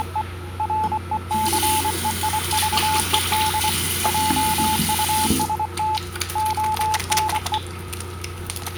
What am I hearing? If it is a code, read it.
Morse code, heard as a keyed tone, hand-sent with a paddle, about 24 wpm, 870 Hz, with the noise of a restroom. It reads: … RECEIVED JUST ONE